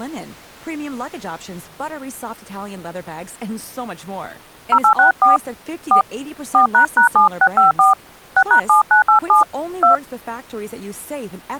DTMF, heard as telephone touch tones, dialled by hand, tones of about 100 ms, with speech in Swedish. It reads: 0864 4 4##7654 6#7987 2